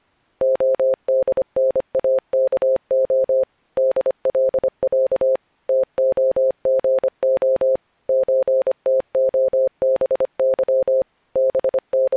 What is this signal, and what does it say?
Morse code (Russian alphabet), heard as a keyed tone, machine-sent, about 25 wpm, 530 Hz. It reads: ОДНАКО ДЛЯ ТОГО ЧТОБЫ …